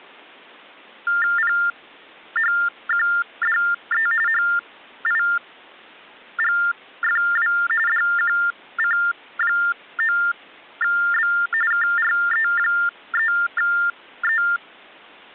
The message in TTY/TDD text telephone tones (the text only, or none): PHQDE HIGFW DQC9B KRE3E